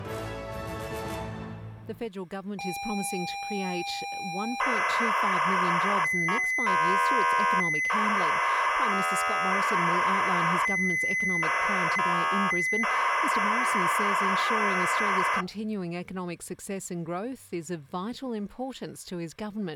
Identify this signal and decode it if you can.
ZX Spectrum tape loading, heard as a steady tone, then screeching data.